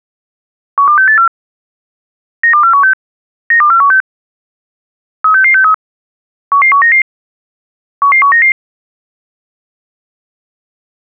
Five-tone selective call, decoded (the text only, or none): 12684 92416 92416 36663 11199 11199